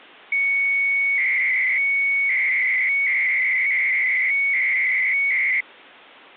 300-baud modem data (Bell 103 tones), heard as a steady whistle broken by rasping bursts, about 300 baud, 200 Hz shift.